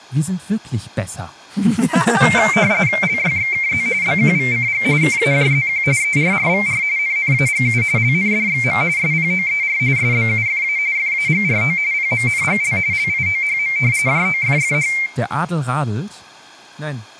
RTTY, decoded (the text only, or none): LYXKZ BQVCG KAJZQ ERRVR NNAGU LNDXM SPOER SBUFA FAGRO PMNGL LIOHM JOFFH